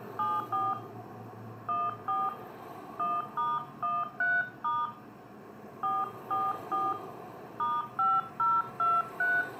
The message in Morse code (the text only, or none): none